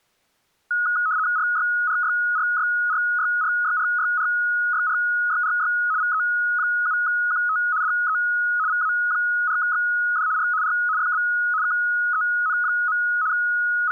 RTTY (75 baud, 170 Hz shift), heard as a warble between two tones, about 1360 Hz centre. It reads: RYRYRYRYRYRYRYRYRY VE7QT DE VA4XD R R FB KEN. …